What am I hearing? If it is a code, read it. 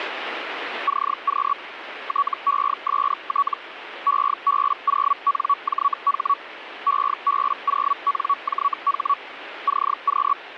Hellschreiber (Feld-Hell, 122.5 baud), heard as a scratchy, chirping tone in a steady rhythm, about 1130 Hz, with radio static. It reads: CQ TEST EB0NJH EB0NJH CQ